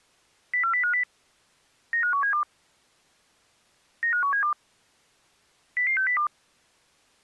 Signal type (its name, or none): five-tone selective call